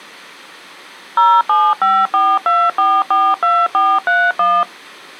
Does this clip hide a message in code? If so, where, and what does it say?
Yes: DTMF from 1.2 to 4.6 s, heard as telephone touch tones, dialled by machine, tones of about 240 ms. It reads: 07542442431